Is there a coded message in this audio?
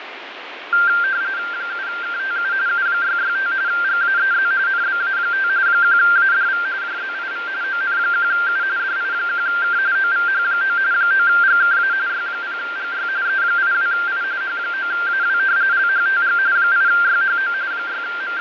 Yes: RTTY (45.45 baud, 170 Hz shift) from 0.7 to 18.4 s, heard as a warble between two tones, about 1480 Hz centre, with radio static and fading. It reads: 7KTU U665 GAEZ NBA5 1ADV JZIV ON1U DI1K OVH9 9GKA Y0GY E82I H9AW LHTG 8YHO …